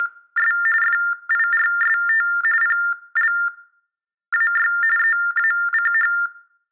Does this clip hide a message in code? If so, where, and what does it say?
Yes: TTY/TDD text telephone tones (45.45 baud Baudot) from 0.0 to 6.3 s, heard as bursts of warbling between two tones, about 400 Hz shift, 1600 Hz centre, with room echo. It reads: … FIRST PLAY EACH